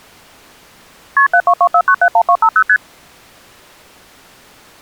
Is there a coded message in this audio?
Yes: multi-frequency trunk signalling (R1, as on North American trunks) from 1.2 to 2.8 s, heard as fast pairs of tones, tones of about 70 ms. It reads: KP 7224971250 ST